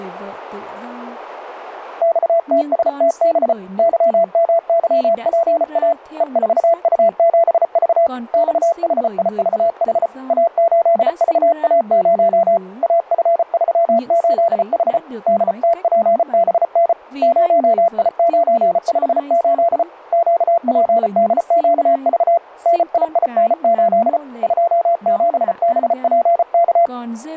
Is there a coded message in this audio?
Yes: Morse code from 2.0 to 26.9 s, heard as a keyed tone, hand-sent with a paddle, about 34 wpm, 680 Hz, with static crashes and speech in Vietnamese. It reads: XTSTB YMYPA E4U7V XHIVH A8VA0 AF38H DTPBN 0I958 QPDQV NIIN8 27BPK